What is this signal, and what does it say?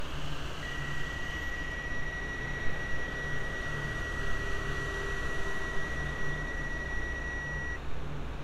PSK31 (31.25 baud), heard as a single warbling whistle, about 1950 Hz, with street noise.